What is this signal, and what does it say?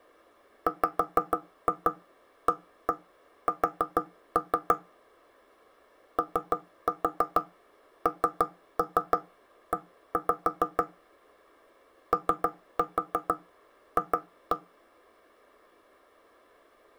Tap code, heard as knocks on wood, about 6 knocks a second. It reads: WAS ONE OF